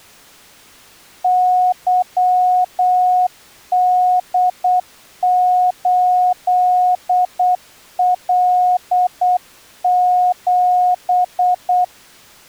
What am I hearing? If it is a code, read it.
Morse code, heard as a keyed tone, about 8 wpm, 730 Hz. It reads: YD8L7